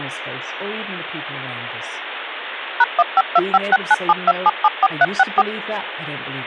DTMF, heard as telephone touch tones, dialled by machine, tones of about 40 ms, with phone line noise and speech in English. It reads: #15256972774364